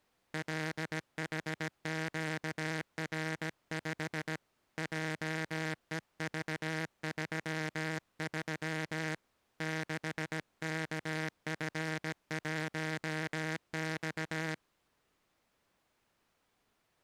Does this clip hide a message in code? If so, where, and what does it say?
Yes: Morse code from 0.3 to 14.6 s, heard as a buzzer, hand-sent with a paddle, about 17 wpm. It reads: LHQR5 JEV33 6KF1X